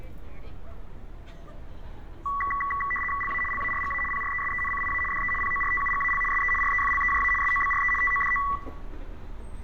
RTTY (75 baud, 850 Hz shift), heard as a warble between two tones, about 1550 Hz centre, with room echo and street noise. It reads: LA LARGA PRESENCIA DE PORTUGAL SE REFLEJA SOBRE TODO